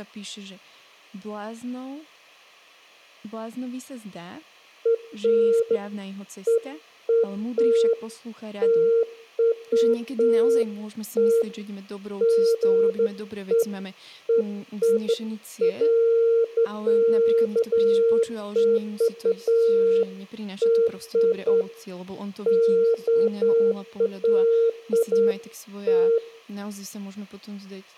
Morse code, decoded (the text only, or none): none